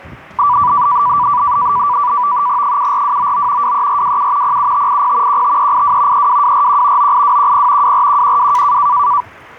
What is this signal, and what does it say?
NAVTEX (SITOR-B), 100 baud, 170 Hz shift, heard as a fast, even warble, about 1070 Hz centre, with the noise of a park. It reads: 74299 23427 07580 15382 32241 98210 24112